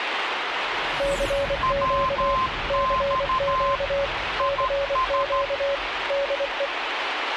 Morse code, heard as two keyed tones, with radio static. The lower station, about 24 wpm, 560 Hz: CQ CQ CQ DE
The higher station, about 13 wpm, 1040 Hz: WX IS